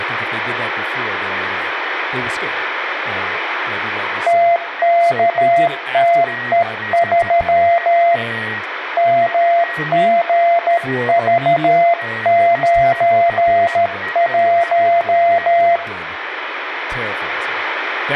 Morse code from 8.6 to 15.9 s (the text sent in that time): MGV91